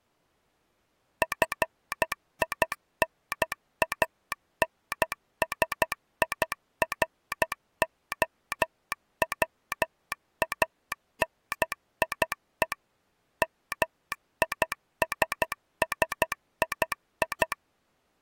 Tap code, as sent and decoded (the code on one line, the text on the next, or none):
none